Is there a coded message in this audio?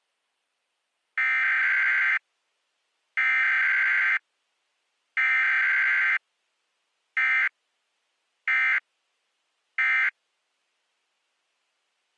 Yes: Emergency Alert System (SAME) tones (header bursts, then end-of-message bursts) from 1.2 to 10.1 s, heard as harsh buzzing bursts, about 520.83 baud.